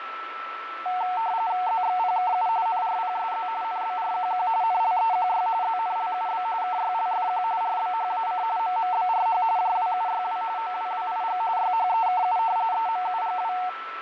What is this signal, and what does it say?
RTTY (45.45 baud, 170 Hz shift), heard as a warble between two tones, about 820 Hz centre, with radio static, fading and a steady whistle near 1330 Hz. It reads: ZXPKU NRPSZ NBRQQ NLEQY ZNLUB KYLFQ RBHAC MMBRH JWUYW OWWIG YHEKU EMUGW